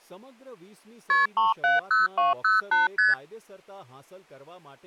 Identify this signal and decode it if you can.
Multi-frequency trunk signalling (R1, as on North American trunks), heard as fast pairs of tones, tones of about 160 ms, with speech in Gujarati. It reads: KP 370208 ST